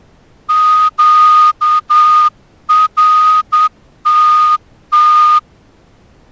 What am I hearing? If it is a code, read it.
Morse code, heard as a whistle, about 9 wpm. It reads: QRTT